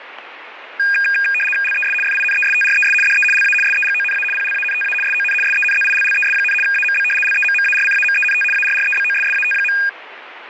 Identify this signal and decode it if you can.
RTTY (75 baud, 850 Hz shift), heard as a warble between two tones, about 2050 Hz centre, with radio static. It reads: LES FINESTRES DE LA SEGONA PLANTA SON SENZILLES, AMB LEMMARCAMENT ARREBOSSAT.